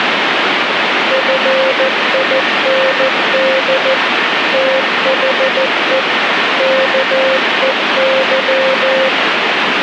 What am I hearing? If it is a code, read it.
Morse code, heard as a keyed tone, machine-sent, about 14 wpm, 530 Hz, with radio static. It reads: FIND THE KEY